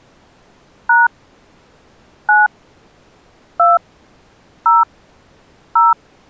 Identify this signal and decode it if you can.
DTMF, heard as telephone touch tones, dialled by hand, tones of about 180 ms. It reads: # 9 2 0 0